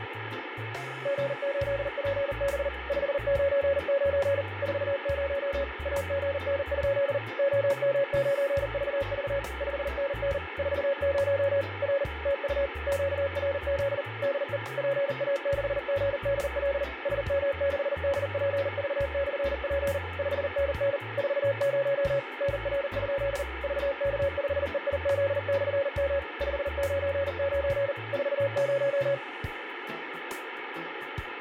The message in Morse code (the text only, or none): G8PB 599 40 AGN? OM9VV 5NN 40 R TU QRZ DE PA6GDL SM6DPV/P 5NN 40 NR? VK5EIZ/M 599 40